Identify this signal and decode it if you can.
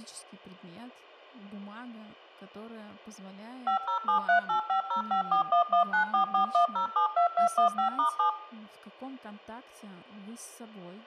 DTMF, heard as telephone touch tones, dialled by machine, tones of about 110 ms, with room echo and speech in Russian. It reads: 507385054119441072215*7